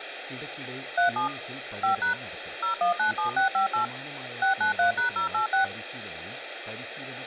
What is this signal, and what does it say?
DTMF, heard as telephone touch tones, dialled by machine, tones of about 120 ms, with phone line noise and speech in Malayalam. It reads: 37 5# 0197658 693#086